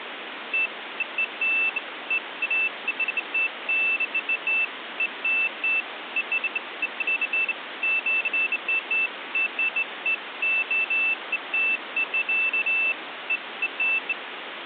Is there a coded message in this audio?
No, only beeps of irregular length, with phone line noise.